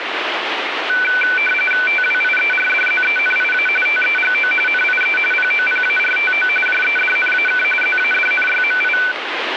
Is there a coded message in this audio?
Yes: RTTY (45.45 baud, 850 Hz shift) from 0.9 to 9.1 s, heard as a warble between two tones, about 1900 Hz centre, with radio static. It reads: TWIERDZENIA TEGO NIE POPARTO JEDNAK ZADNYMI